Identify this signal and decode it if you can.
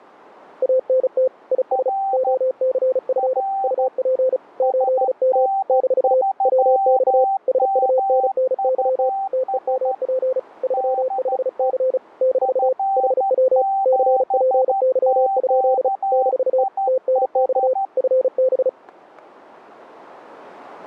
Morse code, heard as two keyed tones. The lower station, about 35 wpm, 520 Hz: ANT IS OCF UP 8M - WX SUNNY TEMP 35C - HW CPY? - TNX FB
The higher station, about 13 wpm, 780 Hz: R R SN3MUS DE F7QIH